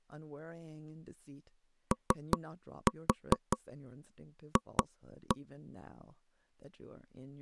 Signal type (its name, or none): tap code